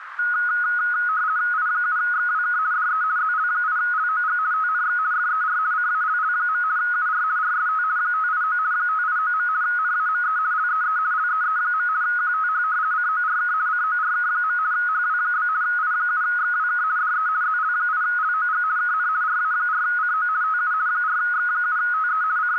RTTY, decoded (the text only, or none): I7XWK DE ZL8LOG TNX FER CALL. UR RST 589 589. NAME LEE LEE. QTH CORK CORK. HW? I7XWK DE ZL8LOG KN RA4CO TU 4X7TE …